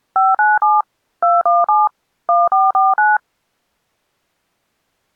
DTMF, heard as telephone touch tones, dialled by machine, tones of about 190 ms. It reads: 597 217 1449